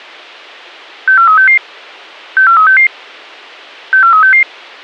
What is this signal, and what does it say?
Five-tone selective call (CCIR), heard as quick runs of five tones, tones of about 100 ms. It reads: 64366 64366 64366